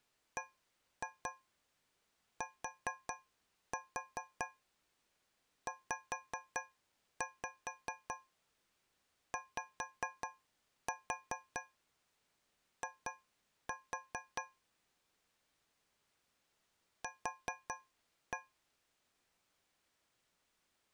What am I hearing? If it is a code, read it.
Tap code, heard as taps on a metal pipe, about 4 knocks a second. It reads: BTZYI Q